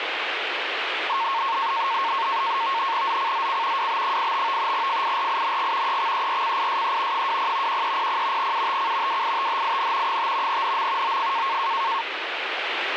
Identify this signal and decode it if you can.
NAVTEX (SITOR-B), 100 baud, 170 Hz shift, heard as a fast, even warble, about 1000 Hz centre, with radio static. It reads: ZCZC WB85 FIRING EXERCISE 20 1300 UTC WITHIN 5 NM OF